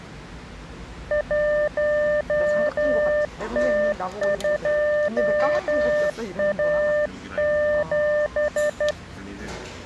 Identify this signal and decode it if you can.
Morse code, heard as a keyed tone, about 12 wpm, 600 Hz, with the noise of a cafe. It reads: 1T2A7